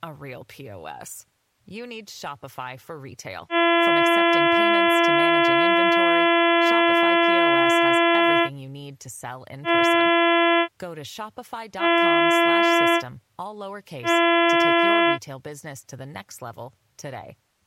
Ship horn signal, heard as a ship's horn, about 340 Hz, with speech in English. 1 long, 3 short. At sea: a vessel under tow in fog.